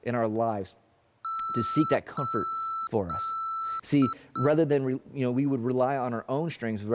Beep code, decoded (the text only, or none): 3 long, 2 short